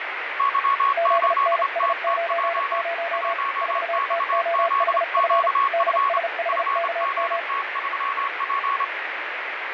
Morse code, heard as two keyed tones, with radio static. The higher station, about 28 wpm, 1110 Hz: Y8TTJ 1XZQF FGT3P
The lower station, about 35 wpm, 680 Hz: ZNS90 4TOHF DSHKM